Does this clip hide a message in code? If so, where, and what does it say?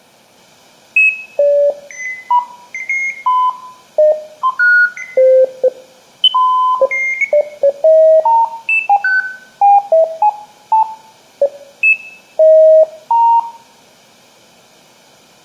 No, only electronic bleeps of random pitch and length, with room echo.